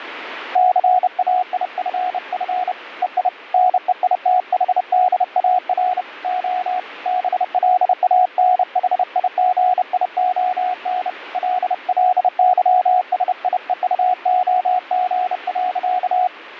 Morse code, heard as a keyed tone, hand-sent with a bug key, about 30 wpm, 730 Hz, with radio static. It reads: CAIFF EI NEITHDAR O BLANHIGION LLYSIEUOG.